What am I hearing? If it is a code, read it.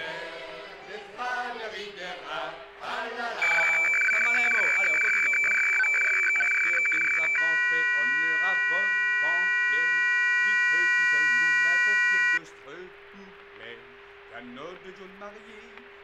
Weather fax (radiofax), 120 lines a minute, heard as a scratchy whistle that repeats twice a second, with static crashes and a steady whistle near 400 Hz.